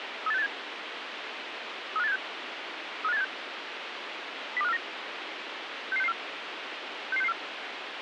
Five-tone selective call (EEA), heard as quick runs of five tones, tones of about 40 ms, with radio hiss. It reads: 38687 35876 35876 02549 66664 66664